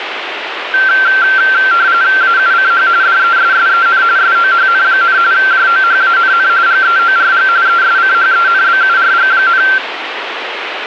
RTTY (45.45 baud, 170 Hz shift), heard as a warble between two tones, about 1460 Hz centre, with radio static. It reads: AUCH DESSEN SOHN, JOHANN GEORG ESCHENBURG,